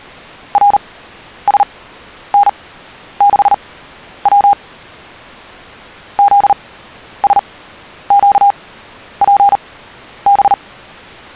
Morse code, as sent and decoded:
.-. ... -. -.... .-- / --.. ... --.- .--. -...
RSN6W ZSQPB

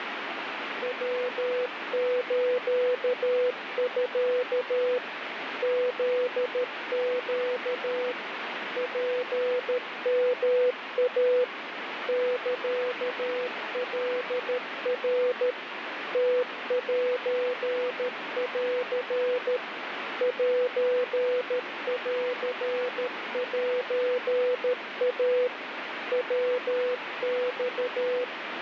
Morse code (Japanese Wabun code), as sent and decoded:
.-- ---.- ..-.- / --.. --.- / .--. -- .- / -.-.- .-.. .-. / - .---. .-.-. / .---. .-.-. .---. .- / .-- -..-
ヤスミ フネ ツヨイ サカナ ムセン センセイ ヤマ

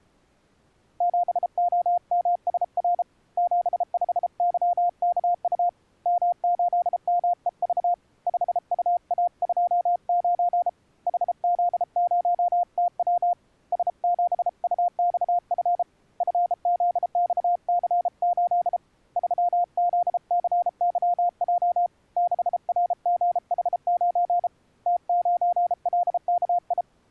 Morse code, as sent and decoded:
--... --- -- ... .-. / --... ..... -.-- -.- ..- / -- ---.. -- . ...- / ..... ..- .- ..--- ----. / .... --.. ----- - .-- / ... --... ..- -..- ..-. / ..-. --.. -..- -.-. ---.. / ...-- --.. -.-. -.-- .--- / -.... .-. --. .... ----. / - ----. .-.. -.- ..
7OMSR 75YKU M8MEV 5UA29 HZ0TW S7UXF FZXC8 3ZCYJ 6RGH9 T9LKI

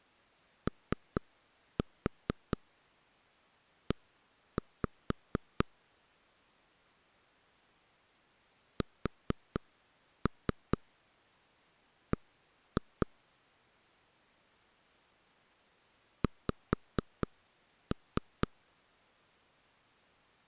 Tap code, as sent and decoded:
3-4 1-5 / 4-3 1-2 / 5-3
OE SB X

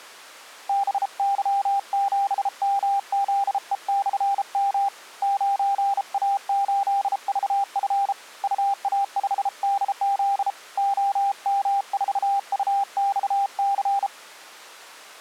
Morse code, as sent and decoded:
-... -.-- --... -- --.. . -..-. -- / ----. .- ---.. ...- ..-. / ..- .- ..... -.. --.. / --- -- ....- ..- -..- -.-.
BY7MZE/M 9A8VF UA5DZ OM4UXC

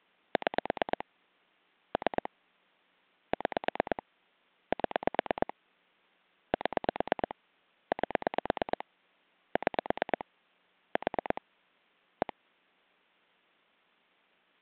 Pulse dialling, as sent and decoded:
6 / 3 / 6 / 7 / 7 / 8 / 6 / 4 / 1
6 3 6 7 7 8 6 4 1

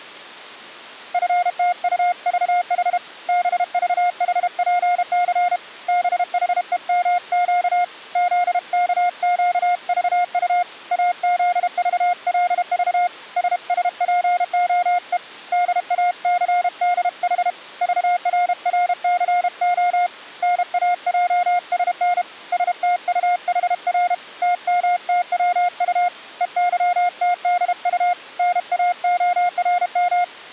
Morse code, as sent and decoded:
..-. - ..- ...- .... / -... ...- .... .--. -.-. / -... .... . -- --.- / --.. -.- --.- ...- ..- / .- --.. ...- .-.. ...- / ... ... .--. --- . / -.. .- -.-. -.. .... / ...- .-. .-. -.-. --- / -. .- .--- ... -. / ... - ..- .... .-. / - -- - .-- ..- / . -.-- - -.. ..- / -. .- --- .-. --
FTUVH BVHPC BHEMQ ZKQVU AZVLV SSPOE DACDH VRRCO NAJSN STUHR TMTWU EYTDU NAORM

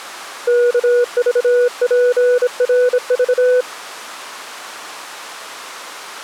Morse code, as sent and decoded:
-.- ...- .--. .-. ...-
KVPRV

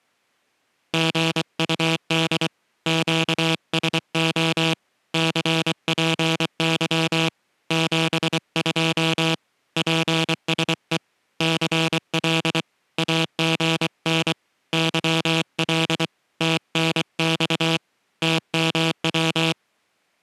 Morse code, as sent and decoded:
--. ..- -.. / --.- ... --- / -.-. .--. -.-- / --... ..--- / .--. ... . / -.-. .-.. / .- --. -. / -.-- .-.. / - -. -..- / - -- .--
GUD QSO CPY 72 PSE CL AGN YL TNX TMW

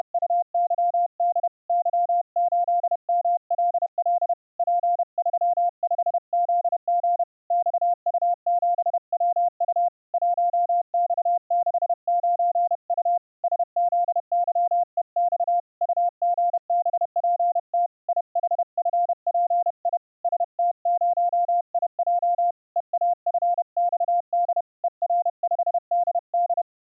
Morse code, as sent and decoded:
… / -.-- ---.. -- .-.. .-.. / .--. ...-- ..... --.. --. / -..- ..- --... .-- ..- / .---- -..- -.... ----. ..- / ... --.. -.-- . -..- / ..- --. -... .--. - / .. .... ..-. .--. .. / ... - ----- .. .--- / . .- ..-. -..- -.. / . .-. ..... -.. -..
… Y8MLL P35ZG XU7WU 1X69U SZYEX UGBPT IHFPI ST0IJ EAFXD ER5DD

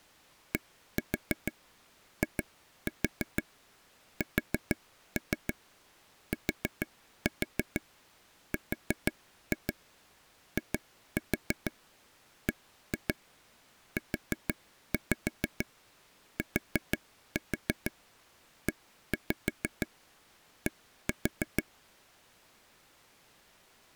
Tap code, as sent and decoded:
1-4 2-4 4-3 4-4 4-2 2-4 1-2 4-5 4-4 1-5 1-4
DISTRIBUTED

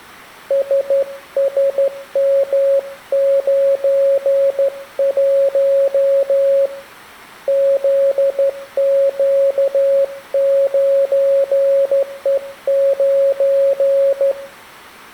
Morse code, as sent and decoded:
... ... -- ----. .---- / --.. --.- ----. . ----.
SSM91 ZQ9E9

